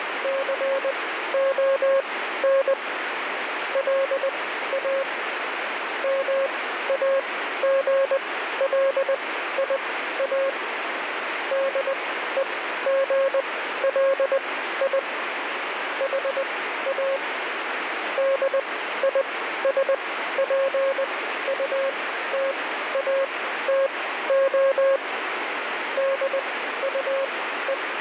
Morse code, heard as a keyed tone, machine-sent, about 20 wpm, spaced as for 13 wpm, 540 Hz, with radio static. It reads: CON LA MAGLIA DEGLI HA DISPUTATO DUE